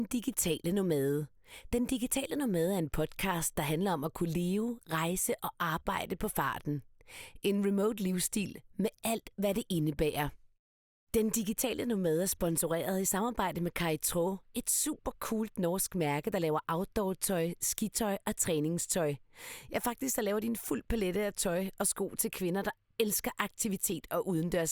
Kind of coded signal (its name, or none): none